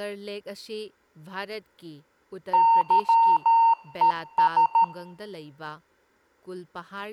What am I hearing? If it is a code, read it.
Morse code, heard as electronic beeps, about 13 wpm, 920 Hz, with speech in Manipuri. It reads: YES